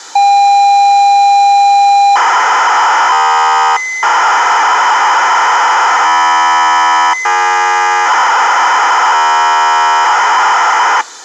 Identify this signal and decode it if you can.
ZX Spectrum tape loading, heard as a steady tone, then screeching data.